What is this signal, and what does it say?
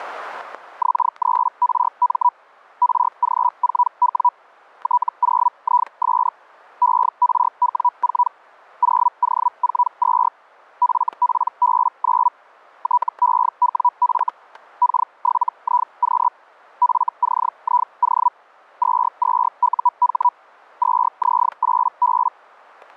Hellschreiber (Feld-Hell, 122.5 baud), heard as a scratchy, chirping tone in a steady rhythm, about 980 Hz, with static crashes. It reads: X3RM RG4W T0IS ERW4 0O42 FPB9 TEWF K7IQ FCIO 22UH 2Z8B